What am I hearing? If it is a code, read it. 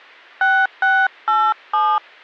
DTMF, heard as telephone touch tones, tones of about 250 ms. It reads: 6687